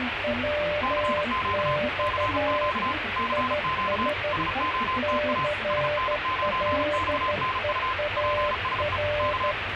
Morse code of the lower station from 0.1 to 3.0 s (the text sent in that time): WX